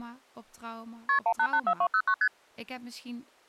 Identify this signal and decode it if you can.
Multi-frequency trunk signalling (R1, as on North American trunks), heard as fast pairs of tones, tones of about 70 ms, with speech in Dutch. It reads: KP 1884209 ST